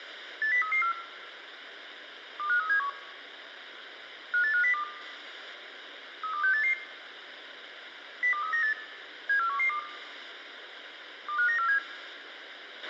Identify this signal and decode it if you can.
Five-tone selective call (CCIR), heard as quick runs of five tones, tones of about 100 ms, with radio hiss and a squelch burst at the end. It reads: 80334 25371 58502 32688 02398 74112 25947